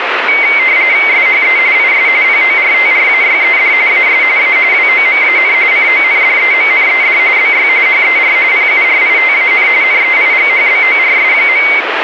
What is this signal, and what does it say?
RTTY (45.45 baud, 170 Hz shift), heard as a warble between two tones, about 2150 Hz centre, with radio static. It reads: SHE IS PORTRAYED AS A WOMAN CONDEMNED BY HER PURITAN NEIGHBORS.